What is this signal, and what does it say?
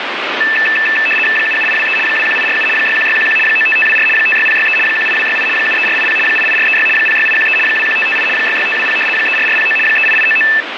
RTTY (75 baud, 850 Hz shift), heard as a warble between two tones, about 2200 Hz centre, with radio static. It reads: 77823 21847 61611 95524 56063 18268 73480 88436 06813 21558 66520 34409 38899